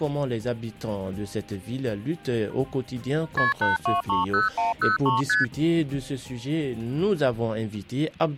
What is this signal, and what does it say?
Multi-frequency trunk signalling (R1, as on North American trunks), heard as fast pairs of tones, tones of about 150 ms. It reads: KP 8230103 ST